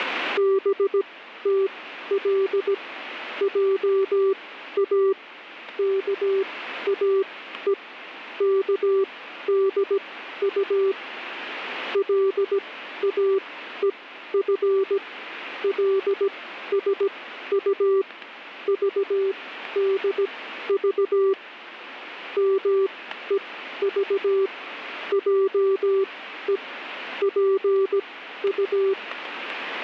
Morse code (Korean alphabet), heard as a keyed tone, machine-sent, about 17 wpm, spaced as for 12 wpm, 390 Hz, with radio static. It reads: 덕호와의 관계를 말하지